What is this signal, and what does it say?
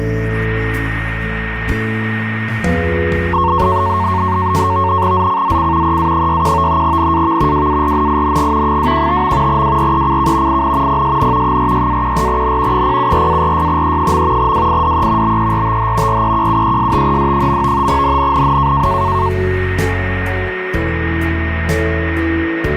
NAVTEX (SITOR-B), 100 baud, 170 Hz shift, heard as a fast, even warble, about 1000 Hz centre, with radio static and a steady whistle near 1850 Hz. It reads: ZCZC EA61 NAV WARNING 215. WRECK IN PSN 46-14N 074-46E. WIDE BERTH REQUESTED. NNNN